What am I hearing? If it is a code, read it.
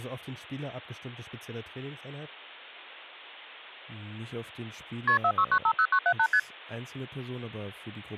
Multi-frequency trunk signalling (R1, as on North American trunks), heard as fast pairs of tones, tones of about 70 ms, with speech in German. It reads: KP 46950978 ST